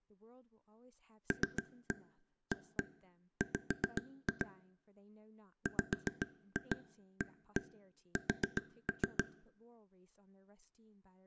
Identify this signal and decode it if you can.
Tap code, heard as taps on a table, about 7 knocks a second, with speech in English. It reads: LAW WAS